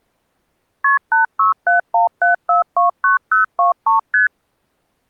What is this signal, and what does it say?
Multi-frequency trunk signalling (R1, as on North American trunks), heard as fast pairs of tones, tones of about 130 ms. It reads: KP 86717429023 ST